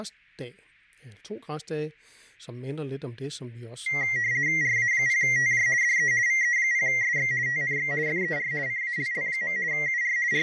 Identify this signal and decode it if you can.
RTTY (50 baud, 170 Hz shift), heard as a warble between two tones, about 2000 Hz centre, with fading and speech in Danish. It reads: RA0TJ DE VE0SX TNX FER CALL. UR …